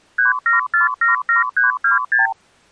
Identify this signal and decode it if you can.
Multi-frequency trunk signalling (R2, with the far end's replies), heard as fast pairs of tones, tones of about 140 ms. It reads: 37477326